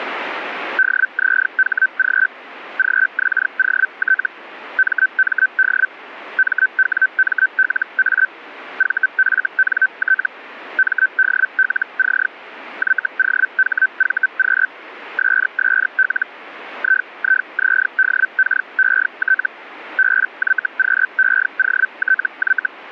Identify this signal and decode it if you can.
Hellschreiber (Feld-Hell, 122.5 baud), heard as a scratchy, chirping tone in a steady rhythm, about 1550 Hz. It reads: DZHG GXOT MMD MWMLA VFNT MDLC YOHVQ SSL IIZDKET BYQEOTY